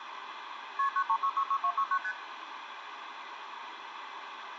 Multi-frequency trunk signalling (R1, as on North American trunks), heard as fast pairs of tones, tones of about 70 ms, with phone line noise. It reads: KP 93666269 ST